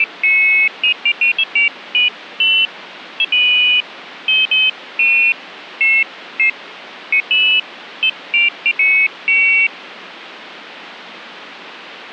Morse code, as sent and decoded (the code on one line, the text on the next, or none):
none